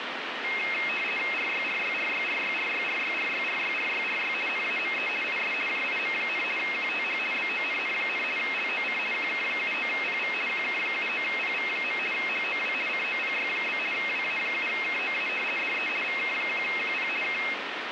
RTTY (50 baud, 450 Hz shift), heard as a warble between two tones, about 2350 Hz centre, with radio static. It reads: RYRYRYRYRYRYRYRYRYRY NAME IS JIM, QTH BONN, LOC QK79PV QK79PV. HOW COPY? WA7KOA DE VK1QP K